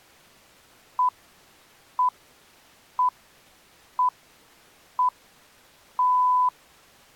Radio time signal (six pips, as the Greenwich Time Signal), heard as pips.